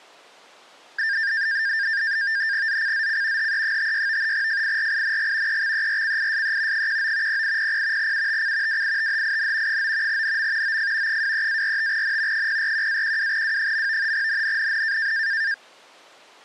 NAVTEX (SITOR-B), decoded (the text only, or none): ZCZC HE56 FIRING EXERCISE 19 0800 UTC WITHIN 9 NM OF 23-45N 041-12W. NNNN